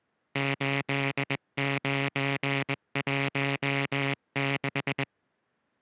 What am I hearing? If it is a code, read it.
Morse code, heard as a buzzer, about 21 wpm. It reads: 8916